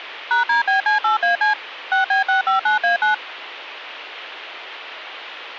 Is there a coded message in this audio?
Yes: DTMF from 0.3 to 3.1 s, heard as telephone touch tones, dialled by machine, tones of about 130 ms. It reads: #DBC8AC 6B659A9